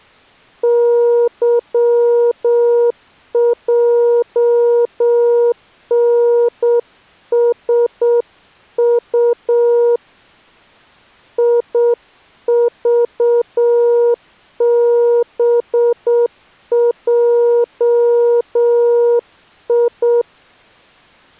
Morse code, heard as a keyed tone, hand-sent with a straight key, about 7 wpm, 480 Hz. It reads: YJNSU IVBJI